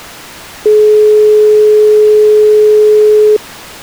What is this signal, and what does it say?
Telephone call progress tone (425 Hz plan, as in most of Europe), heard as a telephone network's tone, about 420 Hz. Dial tone.